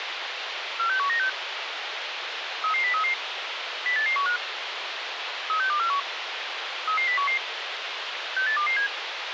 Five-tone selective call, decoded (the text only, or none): 46196 33033 08815 36241 33011 68227